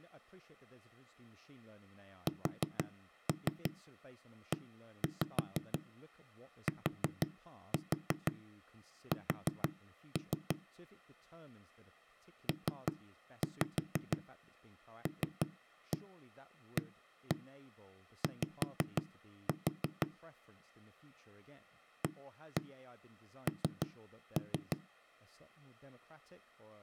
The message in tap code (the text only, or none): SETS PLAY AN